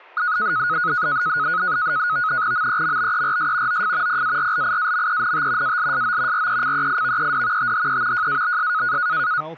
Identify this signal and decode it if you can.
NAVTEX (SITOR-B), 100 baud, 170 Hz shift, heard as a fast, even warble, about 1360 Hz centre, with static crashes and speech in English. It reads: MEMBERS OF PARLIAMENT ALSO RECEIVED THE JABS